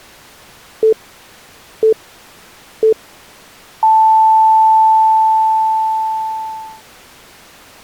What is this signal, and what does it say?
Radio time signal (three low pips and a long one an octave up, as on NHK), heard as pips.